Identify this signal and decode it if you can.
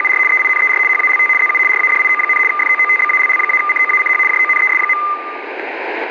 RTTY (75 baud, 850 Hz shift), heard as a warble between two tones, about 1600 Hz centre, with radio static. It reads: … EINER HALT ZU RADIO, FOOTBALL-COACH JONES.